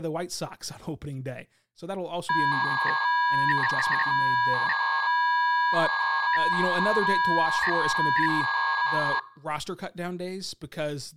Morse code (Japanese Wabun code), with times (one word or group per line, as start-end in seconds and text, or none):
none